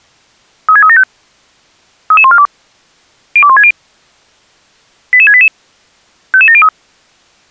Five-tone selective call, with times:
0.7-1.0 36375
2.1-2.5 33142
3.4-3.7 02160
5.1-5.5 88688
6.3-6.7 55703

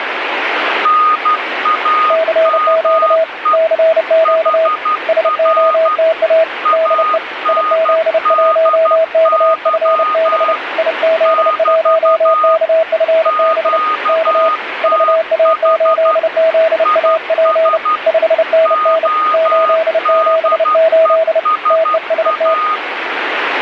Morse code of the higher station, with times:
0.9-3.6 NAME
4.3-6.0 HR
6.7-10.6 ANDY
11.3-12.6 <BT>
13.3-16.2 QTH
16.9-18.0 IS
18.7-22.8 ODESA

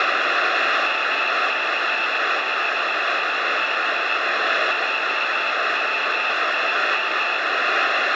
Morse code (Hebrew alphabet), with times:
0.9-4.1 מסביב
4.7-7.4 עצים

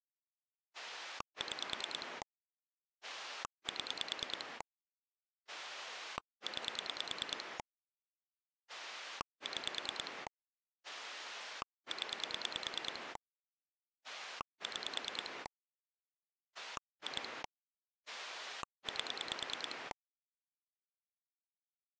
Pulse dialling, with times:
0.7-2.2 6
3.0-4.6 7
5.5-7.6 9
8.7-10.3 6
10.8-13.2 0
14.0-15.5 6
16.6-17.4 2
18.1-19.9 8

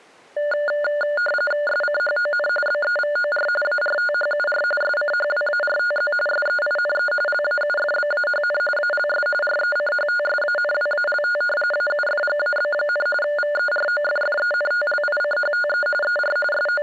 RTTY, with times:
1.7-2.5 SCHON
2.7-3.5 BEVOR
3.6-4.6 ARTHUR
4.8-6.1 SCHWARTZ
6.3-7.1 SEINE
7.3-8.6 LAUFBAHN
8.8-9.3 ALS
9.4-11.4 RECHTSANWALT
11.7-13.1 AUFGAB,
13.2-15.9 VEROFFENTLICHTE
16.0-16.4 ER
16.5-16.8 …

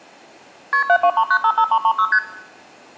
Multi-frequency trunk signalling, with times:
0.7-0.8 KP
0.9-2.1 723955336
2.1-2.2 ST

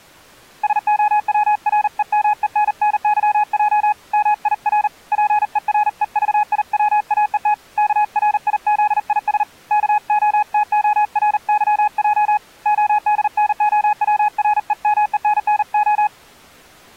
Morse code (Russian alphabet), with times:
0.6-3.9 СОВРЕМЕННЫЙ
4.1-4.9 МИР
5.1-7.5 ПЕРЕЖИВАЕТ
7.8-9.4 КРИЗИС
9.7-12.4 КОТОРЫЙ
12.7-16.1 ОДНОВРЕМЕННО

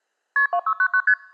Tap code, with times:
none

